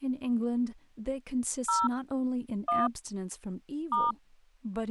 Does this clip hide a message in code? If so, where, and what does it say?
Yes: DTMF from 1.7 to 4.1 s, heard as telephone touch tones, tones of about 190 ms, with speech in English. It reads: 0 1 *